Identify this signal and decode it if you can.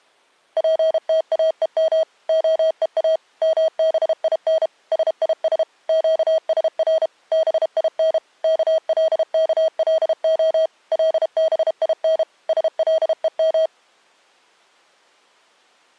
Morse code (Hebrew alphabet), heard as electronic beeps, machine-sent, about 32 wpm, 640 Hz. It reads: פתאום הוא מבין שיש קשר בין כלכלה לבין שלום